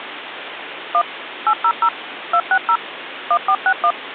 DTMF, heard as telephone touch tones, dialled by machine, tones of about 70 ms, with phone line noise. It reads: 1 800 260 1461